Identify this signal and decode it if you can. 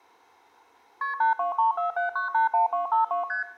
Multi-frequency trunk signalling (R1, as on North American trunks), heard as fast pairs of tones, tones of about 130 ms. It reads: KP 82347981252 ST